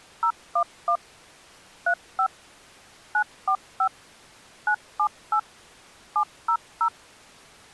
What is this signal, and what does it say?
DTMF, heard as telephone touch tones, dialled by machine, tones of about 80 ms. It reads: 011 35 945 978 700